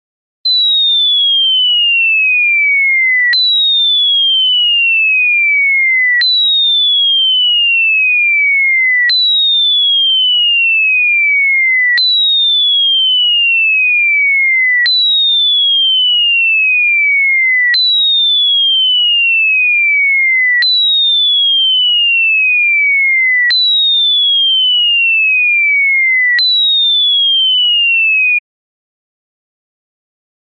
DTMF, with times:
none

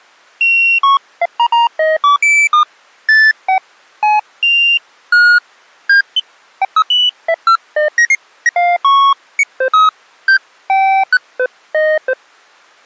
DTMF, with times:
none

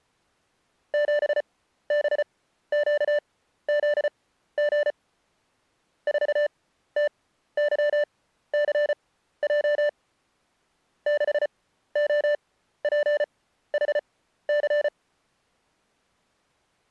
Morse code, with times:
0.9-4.9 7BQZG
6.1-9.9 4TYCJ
11.1-14.9 6OPHC

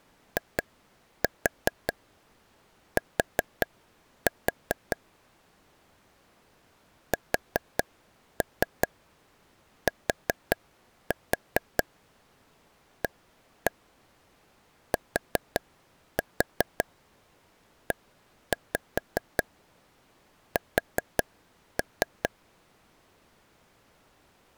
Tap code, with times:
0.4-5.0 IT
7.1-22.3 STATES

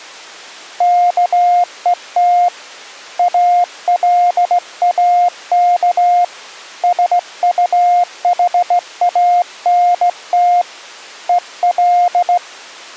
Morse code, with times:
0.8-2.5 KET
3.2-6.2 ALAK
6.8-10.6 SUHANT
11.3-12.4 EL

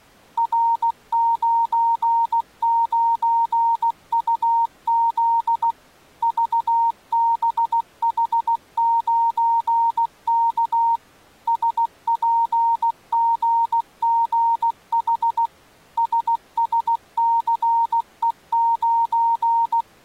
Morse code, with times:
0.4-5.7 R99UZ
6.2-11.0 VBH9K
11.5-15.5 SPGGH
16.0-19.8 SSCE9

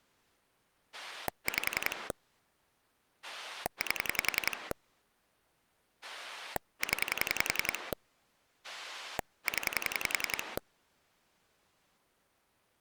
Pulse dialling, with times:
0.9-2.1 5
3.2-4.7 8
6.0-7.9 0
8.6-10.6 0

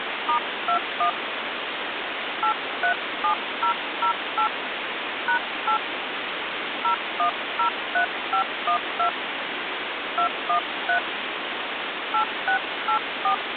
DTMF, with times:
0.3-1.1 *21
2.4-4.5 837008
5.3-5.8 #8
6.8-9.1 0103512
10.2-11.0 213
12.1-13.3 8684

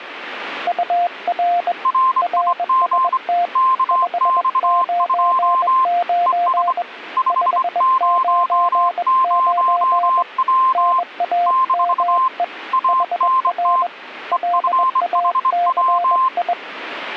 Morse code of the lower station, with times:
0.7-1.7 UR
2.2-3.5 RST
3.9-6.8 599
7.3-10.2 599
10.7-12.4 NAME
12.9-13.9 HR
14.3-16.5 LACI

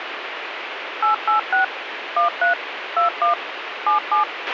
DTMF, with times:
1.0-1.6 886
2.2-2.5 13
3.0-3.3 21
3.9-4.2 77

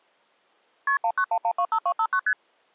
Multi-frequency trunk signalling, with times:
0.9-1.0 KP
1.0-2.2 191125259
2.3-2.3 ST

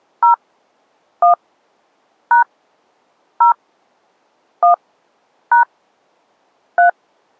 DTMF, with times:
0.2-0.3 0
1.2-1.3 1
2.3-2.4 #
3.4-3.5 0
4.6-4.7 1
5.5-5.6 #
6.8-6.9 3

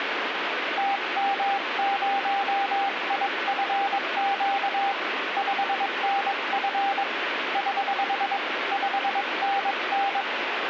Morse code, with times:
0.8-4.9 TM0IFQ
5.4-7.0 5NF
7.6-8.4 <HH>
8.7-10.2 5NN

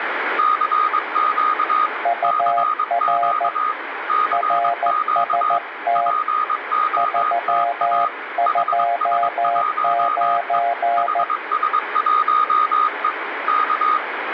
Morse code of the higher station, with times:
0.4-1.9 CQ
2.2-3.7 CQ
4.1-5.6 CQ
6.0-8.1 POTA
8.5-10.6 HS1E
11.0-13.1 HS1E
13.5-14.0 K

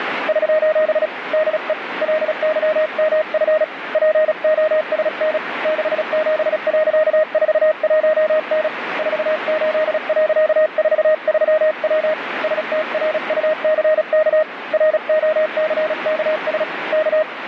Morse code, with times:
0.3-1.1 <SOS>
1.3-1.7 DE
2.0-3.6 LYMF
3.9-5.4 POSN
5.7-8.7 67.41N
9.0-12.1 48.43W
12.4-14.4 STRUCK
14.7-16.6 ROCKS
16.9-17.2 K

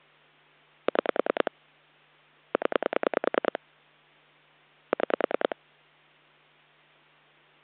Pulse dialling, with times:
0.9-1.5 6
2.5-3.6 0
4.9-5.6 6

